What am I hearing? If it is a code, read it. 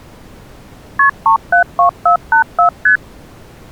Multi-frequency trunk signalling (R1, as on North American trunks), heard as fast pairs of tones, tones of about 100 ms. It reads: KP 372484 ST